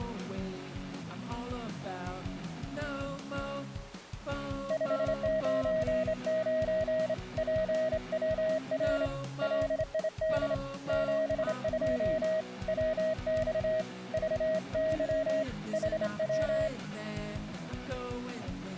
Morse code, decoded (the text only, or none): 599 PWR LID 72 WX VY HW